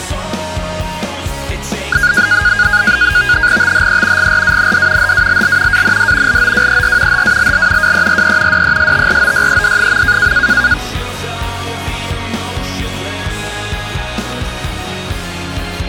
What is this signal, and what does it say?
NAVTEX (SITOR-B), 100 baud, 170 Hz shift, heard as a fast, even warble, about 1550 Hz centre. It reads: THE GRAND HALL AND LOWER HALL WERE DESTROYED.